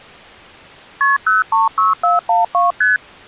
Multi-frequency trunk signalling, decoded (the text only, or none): KP 036412 ST